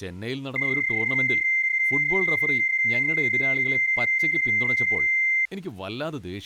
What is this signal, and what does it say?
PSK31 (31.25 baud), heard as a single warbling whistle, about 2100 Hz, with speech in Malayalam.